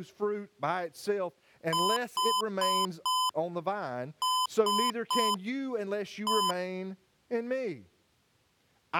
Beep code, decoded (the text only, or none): 4-3-1